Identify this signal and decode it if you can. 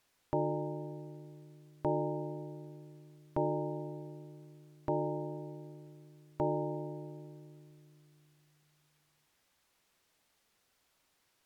Clock strike, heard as a bell. 5. Five o'clock.